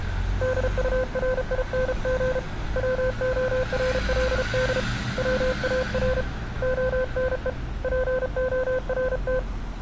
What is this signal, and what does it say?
Morse code, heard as a keyed tone, hand-sent with a paddle, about 34 wpm, 510 Hz, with street noise. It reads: DURING WORLD WAR ONE PORT